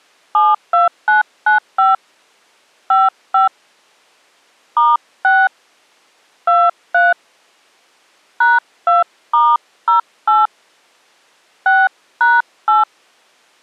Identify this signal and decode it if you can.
DTMF, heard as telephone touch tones, dialled by hand, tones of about 180 ms. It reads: 72995 55 *6 23 #2*08 6#8